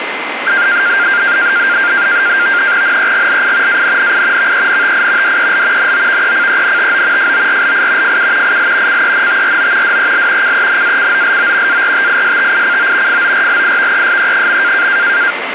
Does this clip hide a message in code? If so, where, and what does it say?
Yes: NAVTEX (SITOR-B), 100 baud, 170 Hz shift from 0.5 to 15.3 s, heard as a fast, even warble, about 1500 Hz centre, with radio static and a steady whistle near 2070 Hz. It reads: NEGLI ANNI VENTI DEL NOVECENTO FORLI FU IL CENTRO DEL CENACOLO ARTISTICO FORLIVESE.